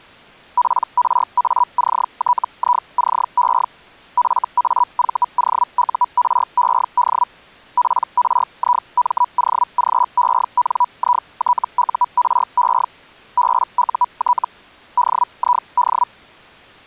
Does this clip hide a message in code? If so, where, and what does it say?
Yes: Hellschreiber (Feld-Hell, 122.5 baud) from 0.6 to 16.1 s, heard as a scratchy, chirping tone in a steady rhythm, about 980 Hz. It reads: PRACTICE FAVOURED PRIMOGENITURE BUT DID